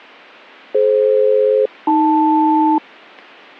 Aircraft SELCAL, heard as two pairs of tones. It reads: DF-AL